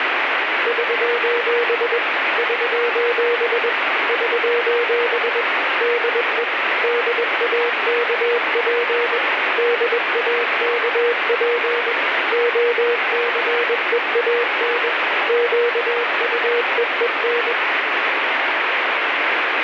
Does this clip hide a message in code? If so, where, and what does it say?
Yes: Morse code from 0.6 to 17.6 s, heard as a keyed tone, machine-sent, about 21 wpm, 480 Hz, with heavy radio static. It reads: <SOS> <SOS> <SOS> DE DAKP DAKP OCEAN QUEEN